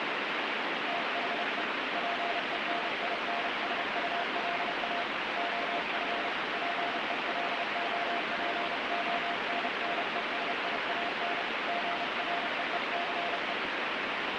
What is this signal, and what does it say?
Morse code, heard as a keyed tone, hand-sent with a paddle, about 31 wpm, 690 Hz, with heavy radio static. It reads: THE PENINSULA OF PELOPONNESIAN GREECE